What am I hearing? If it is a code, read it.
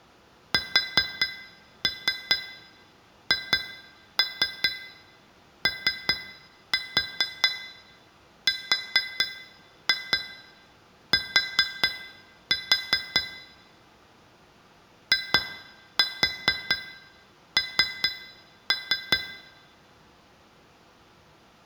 Tap code, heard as taps on glass, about 4 knocks a second, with room echo. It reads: SHORT IN